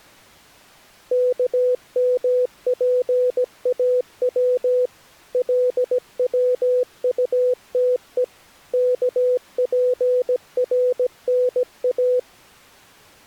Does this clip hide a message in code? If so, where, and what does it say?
Yes: Morse code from 1.1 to 12.3 s, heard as a keyed tone, machine-sent, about 17 wpm, 500 Hz. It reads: KMPAW LWUTE KPRNA